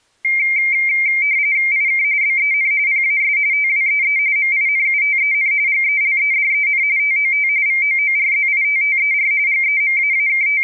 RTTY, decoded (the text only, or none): IK BEN PAS TWEE MINUTEN GELEDEN TOT VOORZITTER …